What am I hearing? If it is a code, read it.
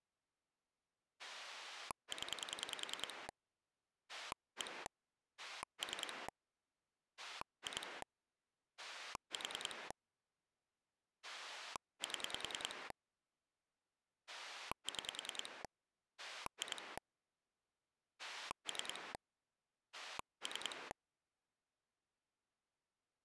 Pulse dialling, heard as a rotary dial, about 10 pulses a second. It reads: 0 1 3 2 4 7 6 2 3 3